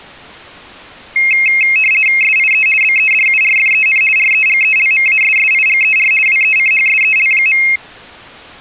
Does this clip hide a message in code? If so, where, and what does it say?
Yes: RTTY (50 baud, 450 Hz shift) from 1.2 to 7.8 s, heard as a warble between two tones, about 2350 Hz centre. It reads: SIE BEDURFEN REGELMASSIGER WECHSEL.